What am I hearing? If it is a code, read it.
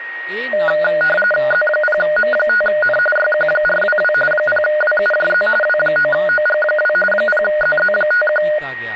RTTY (45.45 baud, 850 Hz shift), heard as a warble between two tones, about 1030 Hz centre, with a steady whistle near 1880 Hz and speech in Dogri. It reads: Z0M5N YQ422 0WUJZ W9OG2 0ZZ51